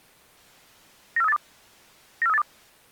Five-tone selective call (EEA), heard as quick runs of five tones, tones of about 40 ms. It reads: 94382 94382